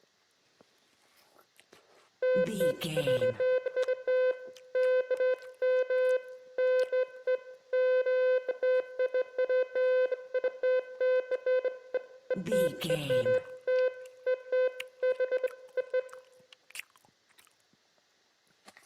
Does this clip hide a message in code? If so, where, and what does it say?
No, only beeps of irregular length, with room echo.